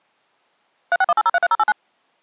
DTMF, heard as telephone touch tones, dialled by machine, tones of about 40 ms. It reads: 3618033089